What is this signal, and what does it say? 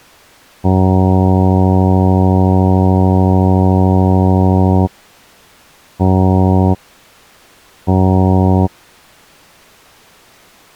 Ship horn signal, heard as a ship's horn, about 90 Hz. 1 long, 2 short. At sea: a vessel in fog that is sailing, fishing, towing or hampered.